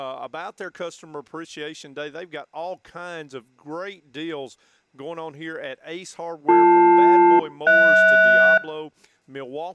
Aircraft SELCAL, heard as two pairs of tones. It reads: BL-HS